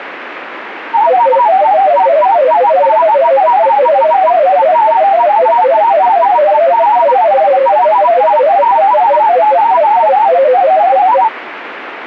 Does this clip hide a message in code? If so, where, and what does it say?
Yes: multi-tone FSK (Olivia or MFSK type), about 500 Hz wide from 0.9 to 11.3 s, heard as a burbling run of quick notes, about 31.25 baud, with radio static.